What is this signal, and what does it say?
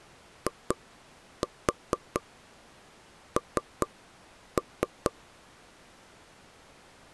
Tap code, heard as taps on a table, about 4 knocks a second. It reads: IN